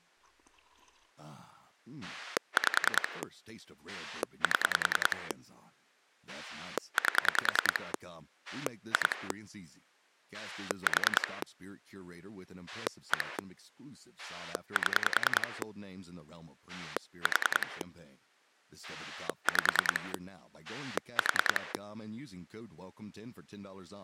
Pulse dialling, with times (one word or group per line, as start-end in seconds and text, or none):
2.0-3.2 5
3.9-5.3 7
6.3-7.9 8
8.5-9.3 2
10.3-11.4 4
12.7-13.4 1
14.2-15.6 7
16.7-17.8 4
18.8-20.1 5
20.6-21.7 4